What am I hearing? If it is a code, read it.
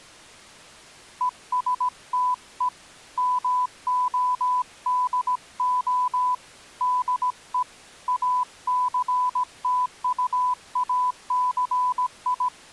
Morse code, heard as a keyed tone, hand-sent with a paddle, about 17 wpm, 1000 Hz. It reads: ESTE MODO DE …